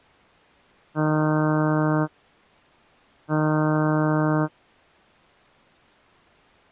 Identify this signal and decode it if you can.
Ship horn signal, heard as a ship's horn, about 150 Hz. 2 short. At sea: I am altering course to port.